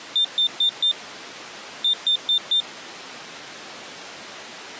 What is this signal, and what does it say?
Beep code, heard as a piezo beeper, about 3600 Hz. 4-4.